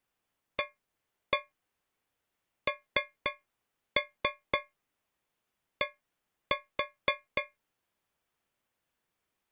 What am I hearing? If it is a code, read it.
Tap code, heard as taps on a metal pipe, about 4 knocks a second. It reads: AND